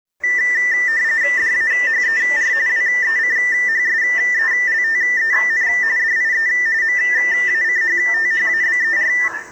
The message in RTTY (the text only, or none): DAHER WECHSELTEN DIE MACHTHABER